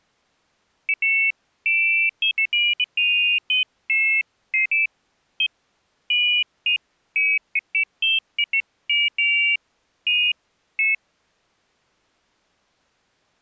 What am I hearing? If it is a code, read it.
Pairs of high tones at irregular times. There is no code.